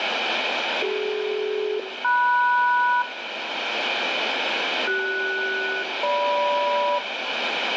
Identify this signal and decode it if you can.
Aircraft SELCAL, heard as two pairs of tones, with radio static and room echo. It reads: CD-MS CS-GM